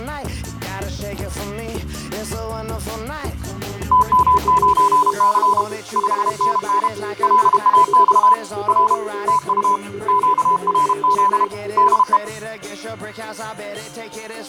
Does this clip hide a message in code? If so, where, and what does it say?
Yes: Morse code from 3.9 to 12.2 s, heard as two keyed tones. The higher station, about 32 wpm, 1000 Hz: TM9C 5NN LAX R TU QRZ DE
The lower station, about 21 wpm, 400 Hz: 2H8ZH 3NR1A